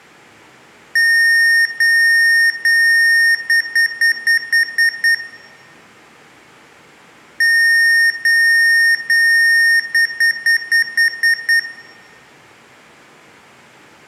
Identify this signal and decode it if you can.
Beep code, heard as beeps from a small speaker, played twice, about 1850 Hz, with room echo. 3 long, 7 short.